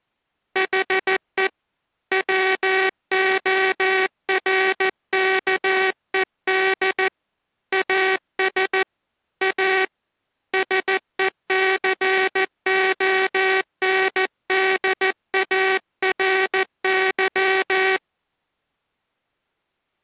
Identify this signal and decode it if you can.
Morse code, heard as a buzzer, hand-sent with a paddle, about 14 wpm. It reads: HE WORKED AS A SECONDARY